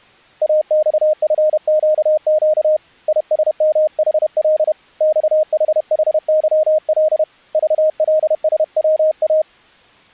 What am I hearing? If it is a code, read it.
Morse code, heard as a keyed tone, hand-sent with a paddle, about 31 wpm, 620 Hz. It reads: AXFQQ ISMHL XHHYL VLSWA